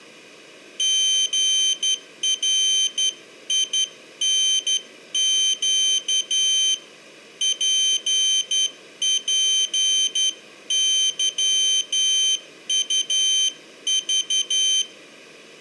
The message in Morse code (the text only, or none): GRINQ PPYUV